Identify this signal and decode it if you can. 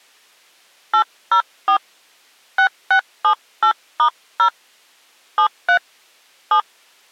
DTMF, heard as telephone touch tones, dialled by hand, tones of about 90 ms. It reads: 804 6678*0 73 7